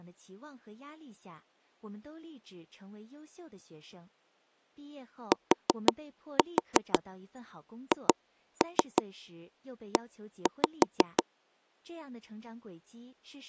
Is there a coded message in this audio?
Yes: tap code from 5.3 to 11.2 s, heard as knocks on wood, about 6 knocks a second, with speech in Chinese. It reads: THE